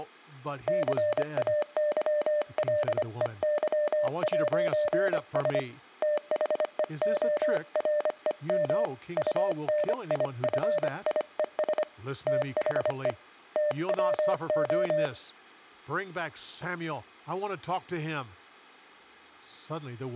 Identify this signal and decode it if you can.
Morse code, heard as a keyed tone, hand-sent with a paddle, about 25 wpm, 590 Hz, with speech in English. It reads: CAYLEY'S THEOREM UNIFIES THE TWO